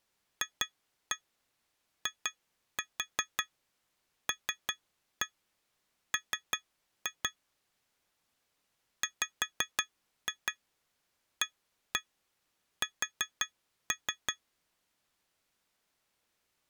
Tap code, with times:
0.4-7.3 FILM
9.0-14.3 WAS

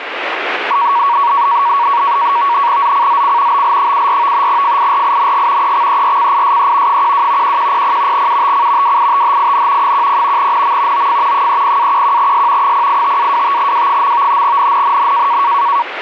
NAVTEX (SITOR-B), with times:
2.8-3.6 ZCZC
3.5-4.5 BL74
4.5-5.7 FIRING
5.6-7.0 EXERCISE
6.9-7.6 12
7.4-8.3 1100
8.1-9.0 UTC
8.8-9.9 WITHIN
9.8-10.5 10
10.4-11.1 NM
10.9-11.5 OF
11.3-12.7 30-11S
12.6-14.4 085-25W.
14.4-15.4 NNNN

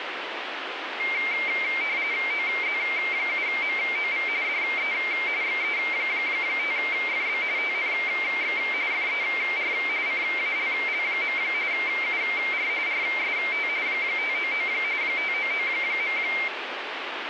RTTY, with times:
2.3-4.3 OZ7MOV
4.4-4.9 DE
5.4-7.4 XE5FB
7.6-8.6 TNX
8.9-9.7 FER
10.1-11.4 CALL.
11.7-12.7 UR
12.9-13.7 RST
13.9-14.7 599
15.0-16.2 599.

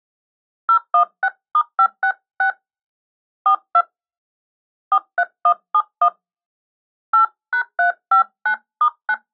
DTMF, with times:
0.7-2.5 016*566
3.5-3.8 42
4.9-6.1 43171
7.1-9.1 8#359*9

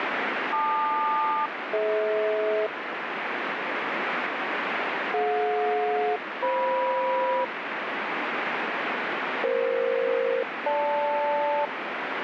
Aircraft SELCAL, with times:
0.5-2.7 LQ-DH
5.1-7.4 DJ-FM
9.4-11.7 EF-GL

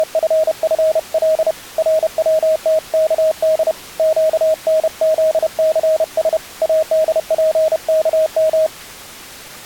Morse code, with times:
0.0-1.5 …
1.8-3.7 RWTKD
4.0-6.4 QNZCS
6.6-8.7 ADPKM

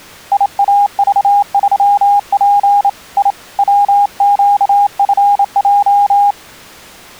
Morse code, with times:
0.3-2.9 IAV3P
3.2-3.3 I
3.6-6.3 WQFJ

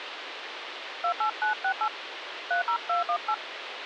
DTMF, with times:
1.0-1.9 28968
2.5-3.3 30218

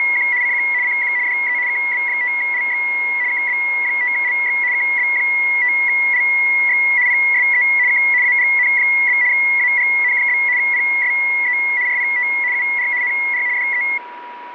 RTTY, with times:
0.0-0.3 …
0.4-0.6 CQ
0.8-1.1 CQ
1.3-1.6 DE
1.7-2.8 KB5LX
3.3-4.6 KB5LX
4.7-6.8 KB5LX
7.1-7.6 PSE
7.9-8.0 K
8.2-9.2 AGN?
9.3-10.4 AGN?
10.6-11.6 PSE
11.9-12.3 RPT
12.5-12.9 UR
13.0-13.4 NR
13.6-13.8 DE

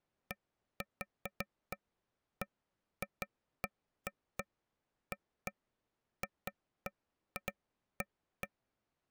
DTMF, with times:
none

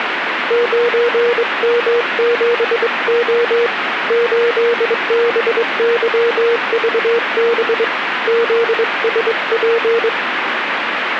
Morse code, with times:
0.5-3.7 9M7O
4.1-7.8 8BYVB
8.3-10.1 ZSP

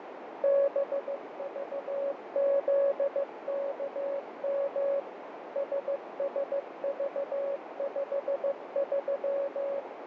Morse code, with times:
0.4-5.0 BVZKM
5.6-9.8 SSV53

